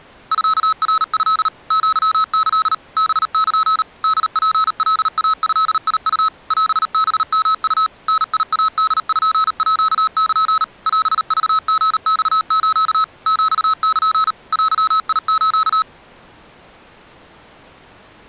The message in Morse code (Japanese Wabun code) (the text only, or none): ミナト アキ ハル ホツカイドウ オハヨウ ダイポール オクリマス ヒル デス